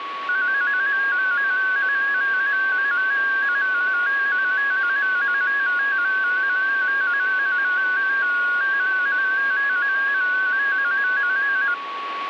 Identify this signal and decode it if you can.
Multi-tone FSK (Olivia or MFSK type), about 250 Hz wide, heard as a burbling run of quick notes, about 15.625 baud, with radio static and a steady whistle near 1120 Hz.